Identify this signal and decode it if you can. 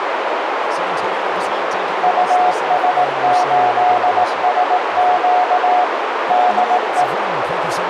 Morse code, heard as a keyed tone, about 18 wpm, 730 Hz, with heavy radio static, a narrow filter and speech in English. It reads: US8SQ DE